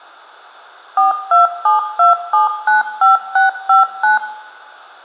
DTMF, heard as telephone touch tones, dialled by machine, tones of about 140 ms, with hum and room echo. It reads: 4272795659